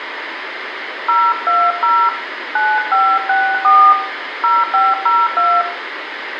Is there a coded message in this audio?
Yes: DTMF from 1.1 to 5.6 s, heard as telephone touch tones, dialled by hand, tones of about 240 ms, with radio hiss and room echo. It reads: 020 9564 0502